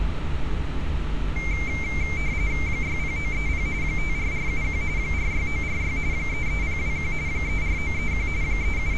RTTY (45.45 baud, 170 Hz shift), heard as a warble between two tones, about 2200 Hz centre, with radio static and street noise. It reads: 60930 54471 46946 33021 34931 …